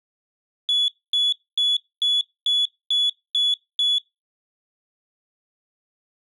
Beep code, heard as a piezo beeper, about 3400 Hz. 8 short. In AMI BIOS tables: display memory failure; in Dell tables: LCD failure.